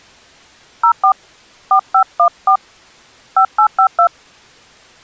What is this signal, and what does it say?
DTMF, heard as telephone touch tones, dialled by hand, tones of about 90 ms. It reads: 04 4514 5852